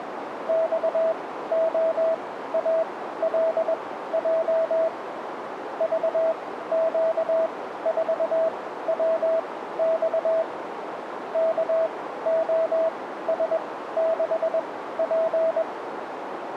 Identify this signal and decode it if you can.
Morse code, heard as a keyed tone, machine-sent, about 21 wpm, spaced as for 14 wpm, 650 Hz, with radio static and a narrow filter. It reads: XOALJ VQ4WX KOS6P